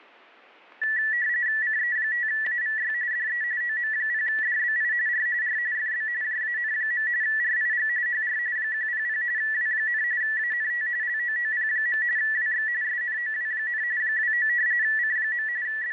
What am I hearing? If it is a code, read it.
RTTY (45.45 baud, 170 Hz shift), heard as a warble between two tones, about 1850 Hz centre, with static crashes. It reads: CE5AVY DE OM0DBI R R FB JAN. RIG HR 100 W, ANT LOOP. WX SNOW, 29 C. …